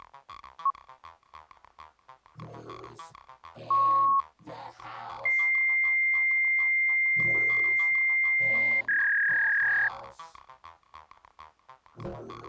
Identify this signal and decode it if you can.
Fax machine handshake, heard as a beep, a long tone and a warble.